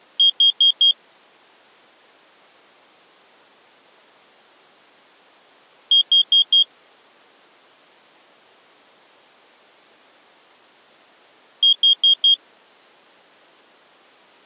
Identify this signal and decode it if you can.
Alarm pattern, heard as an alarm's beeps, played three times, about 3250 Hz. Temporal four. Carbon monoxide.